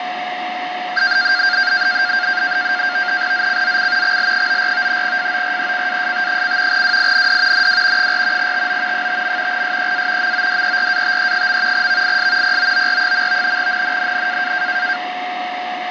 NAVTEX (SITOR-B), 100 baud, 170 Hz shift, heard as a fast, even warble, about 1500 Hz centre, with radio static and a steady whistle near 730 Hz. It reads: ZCZC XL94 FORECAST: WIND NW 4 TO 5. SEA MODERATE. VIS POOR. NNNN